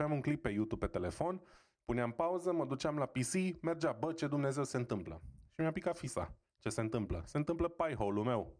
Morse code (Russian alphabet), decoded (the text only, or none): none